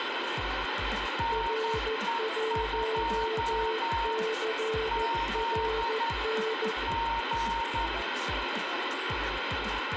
Morse code, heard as two keyed tones, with heavy radio static and room echo. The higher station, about 11 wpm, 920 Hz: NE2 Z G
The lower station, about 14 wpm, 440 Hz: R1CRN